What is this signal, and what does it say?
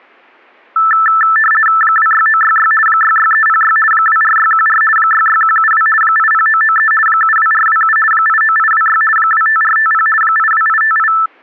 RTTY (50 baud, 450 Hz shift), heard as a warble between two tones, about 1550 Hz centre. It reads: 26966 66306 24614 66172 80993 72427 89826 25450 82858